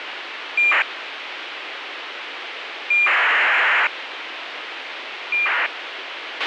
ACARS aircraft data, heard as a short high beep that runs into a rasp, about 2400 baud, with radio hiss and a squelch burst at the end.